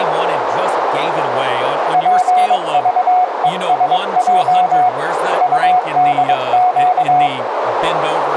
Morse code, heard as a keyed tone, hand-sent with a bug key, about 22 wpm, 730 Hz, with radio static, a narrow filter and speech in English. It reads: PVESJ UDQ